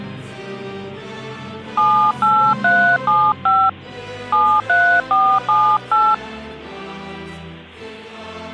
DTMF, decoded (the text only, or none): 78375 73478